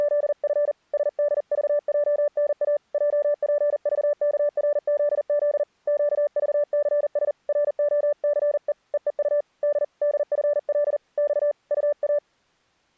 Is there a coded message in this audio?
Yes: Morse code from 0.0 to 12.2 s, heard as a keyed tone, hand-sent with a paddle, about 40 wpm, 590 Hz. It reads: … SDVJNA JPVKRZZ QVCS ROCE EEU D DFL X UA